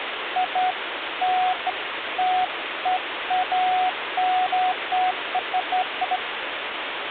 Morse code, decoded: none

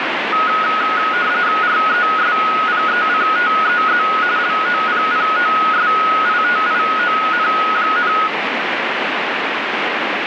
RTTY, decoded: RESPECTEZ LOPPOSITION,

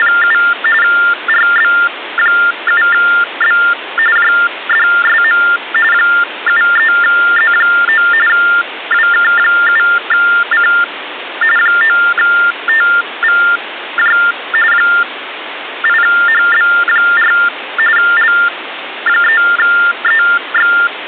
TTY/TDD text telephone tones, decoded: … RB7B JDSM 73Z9 WK7C 9TVJ 8HB4 L3EX

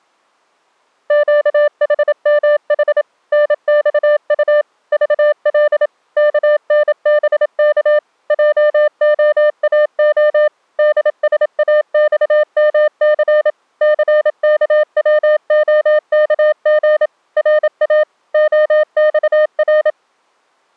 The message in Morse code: QHMH NXU VL KNBK JOAO DSAXMC CKWOKG RA OXR

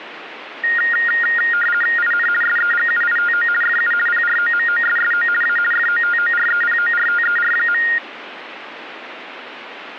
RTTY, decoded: IN SEGUITO FU PROMOSSO A FOTOREPORTER.

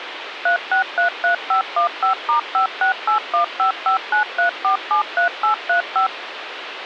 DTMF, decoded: 3633515*56815593473835

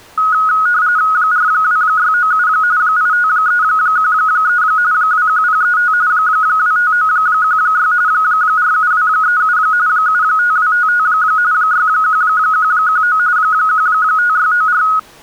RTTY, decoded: 42697 85313 21035 25916 47237 75255 61119 15694

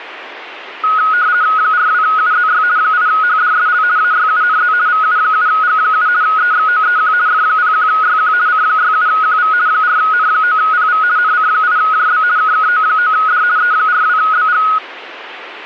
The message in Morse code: none

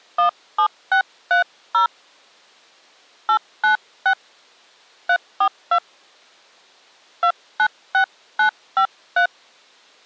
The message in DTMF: 17630 896 342 296953

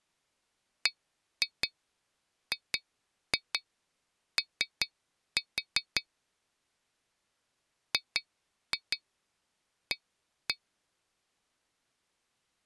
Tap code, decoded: BGO GA

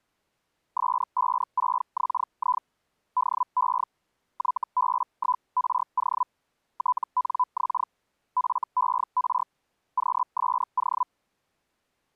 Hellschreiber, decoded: S56XI DE YB1RO TNX FER QSO

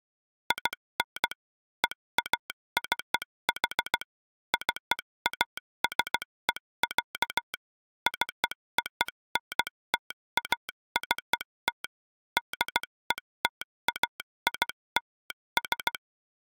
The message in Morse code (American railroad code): IN EACH CASE, CONTACT DETAILS

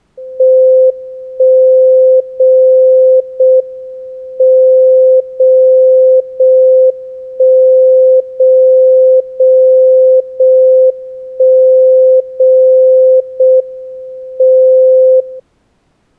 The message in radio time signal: 1 0 0 M 0 0 1 0 0 0 1 0 0 M 0

